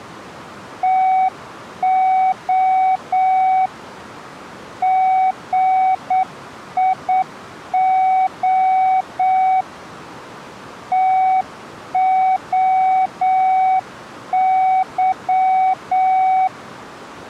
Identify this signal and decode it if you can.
Morse code (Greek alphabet), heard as a keyed tone, hand-sent with a straight key, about 8 wpm, 750 Hz. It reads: ΤΟ ΓΙΟ ΤΟΥ